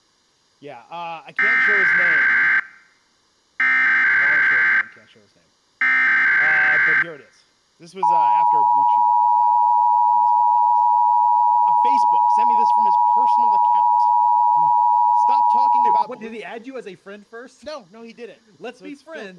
Emergency Alert System (SAME) tones (header bursts, then the 853 and 960 Hz attention tone), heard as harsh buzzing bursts, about 520.83 baud, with speech in English.